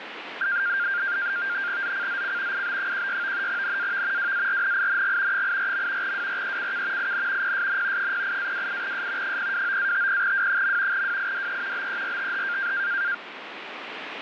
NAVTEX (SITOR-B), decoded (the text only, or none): ZCZC IB16 NAV WARNING 84. WRECK IN PSN 08-28S 029-50W. WIDE BERTH